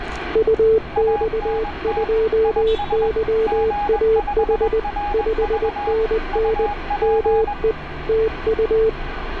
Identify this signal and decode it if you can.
Morse code, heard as two keyed tones, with radio static and street noise. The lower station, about 20 wpm, 440 Hz: UX2YAH 5NN ME TU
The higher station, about 21 wpm, 820 Hz: ANT IS G5RV UP